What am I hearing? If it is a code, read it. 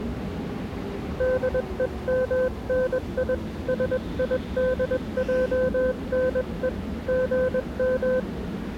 Morse code (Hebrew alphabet), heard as a keyed tone, hand-sent with a paddle, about 21 wpm, 510 Hz, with the noise of a subway station. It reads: דומני שידענו גם